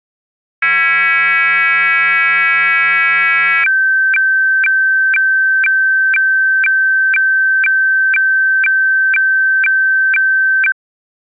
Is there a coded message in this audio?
Yes: weather fax (radiofax), 120 lines a minute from 0.6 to 10.7 s, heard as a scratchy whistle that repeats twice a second.